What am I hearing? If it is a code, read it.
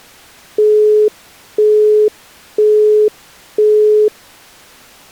Telephone call progress tone (single-tone plan, as in Europe, Japan and elsewhere), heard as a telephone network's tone, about 420 Hz, 0.5 s on and 0.5 s off. Busy tone.